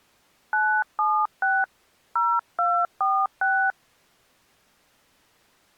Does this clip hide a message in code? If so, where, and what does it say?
Yes: DTMF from 0.5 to 3.7 s, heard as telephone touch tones, dialled by hand, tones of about 260 ms. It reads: 976 0246